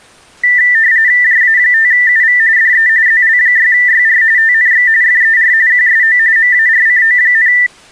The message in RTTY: JA5UV DE ZL6YR TNX FER QSO MARCO,

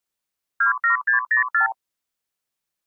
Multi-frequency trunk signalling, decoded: 27604

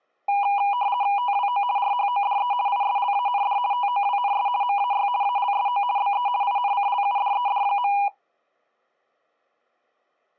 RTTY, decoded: TWO RHODE ISLAND TOWNS MAY ALSO BE INCLUDED.

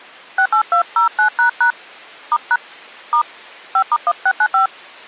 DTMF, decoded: 68209## *# * 5*1695

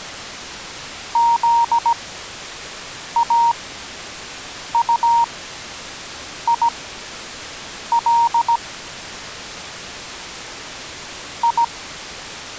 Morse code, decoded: ZAUIL I

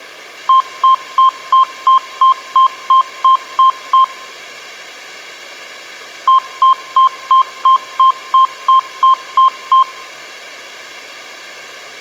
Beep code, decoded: 11 short

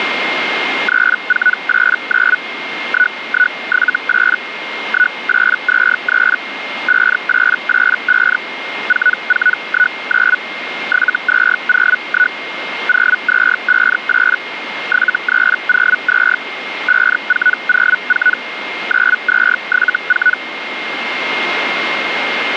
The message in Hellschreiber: 3489 1178 1823 5885 4419 7201 0258 7302 5404 9274

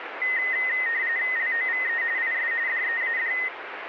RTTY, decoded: LOVE IS DEAD

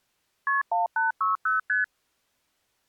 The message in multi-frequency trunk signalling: KP 1860 ST

